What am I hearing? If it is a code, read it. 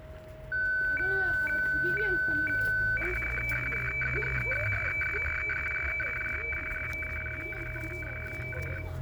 Weather fax (radiofax), 120 lines a minute, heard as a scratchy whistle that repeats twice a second, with fading, a steady whistle near 630 Hz, room echo and the noise of a residential street.